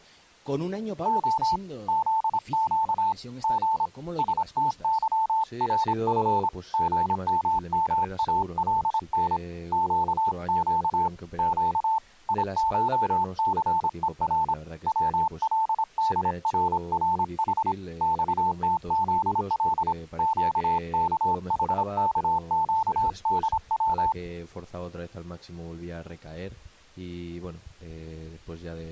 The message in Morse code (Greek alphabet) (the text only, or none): Ο ΖΨ Γ ΣΤΥΡΦ ΓΜΜΑΛΝ ΨΨ Ψ ΙΧΘΕΡ ΩΛΔΡΡΗ ΞΤΖΛ ΨΚΗΚΨΔΩ